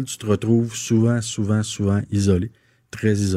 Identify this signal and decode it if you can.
Speech in French. There is no code.